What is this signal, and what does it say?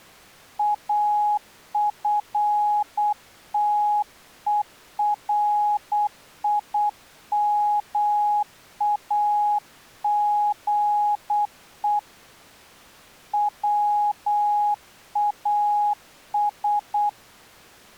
Morse code, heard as a keyed tone, hand-sent with a paddle, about 8 wpm, 830 Hz. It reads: AFTERIMAGE WAS